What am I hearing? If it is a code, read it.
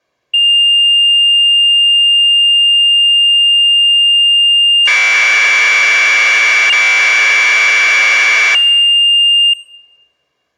Commodore tape loading (standard loader), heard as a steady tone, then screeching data.